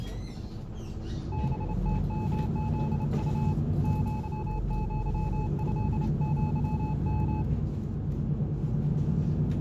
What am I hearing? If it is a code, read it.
Morse code (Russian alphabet), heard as a keyed tone, hand-sent with a bug key, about 28 wpm, 860 Hz, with the noise inside a bus. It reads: БТМЗУ ЪЪЭЪМ